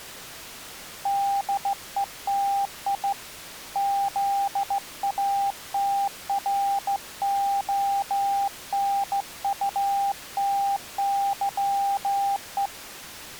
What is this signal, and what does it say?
Morse code (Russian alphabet), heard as a keyed tone, hand-sent with a straight key, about 15 wpm, 800 Hz. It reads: ДЕТИ ЗАТРОНУТЫЕ